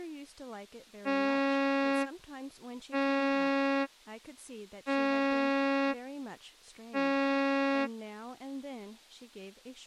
Ship horn signal, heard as a ship's horn, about 280 Hz, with speech in English. 4 short. At sea: a pilot vessel's identity signal in fog.